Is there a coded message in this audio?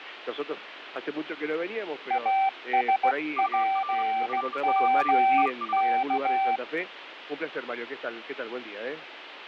Yes: Morse code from 2.0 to 6.6 s, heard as two keyed tones, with radio static. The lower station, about 16 wpm, 770 Hz: ASPMK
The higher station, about 31 wpm, 1180 Hz: UR RST IS